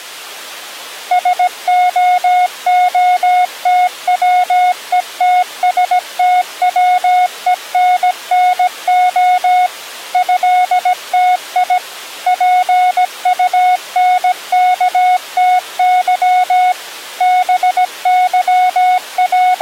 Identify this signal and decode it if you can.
Morse code (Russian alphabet), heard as a keyed tone, machine-sent, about 17 wpm, 730 Hz. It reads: СООТВЕТСТВЕННО ЭТИ ПУНКТЫ …